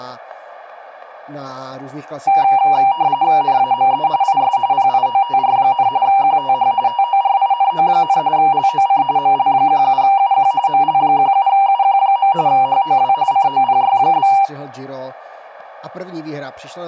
RTTY (45.45 baud, 170 Hz shift), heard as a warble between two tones, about 870 Hz centre, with static crashes and speech in Czech. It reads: NAME IS PIOTR, QTH TORINO, LOC ML17UQ ML17UQ. HOW COPY?